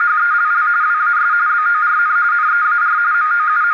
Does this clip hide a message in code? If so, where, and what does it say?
Yes: RTTY (45.45 baud, 170 Hz shift) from 0.0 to 3.7 s, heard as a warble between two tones, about 1330 Hz centre, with radio static and a narrow filter. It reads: … WAS BORN NEAR …